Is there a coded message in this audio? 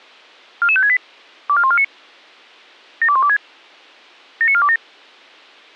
Yes: five-tone selective call (ZVEI) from 0.6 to 4.8 s, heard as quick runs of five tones, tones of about 70 ms. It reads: 44568 24149 72126 79427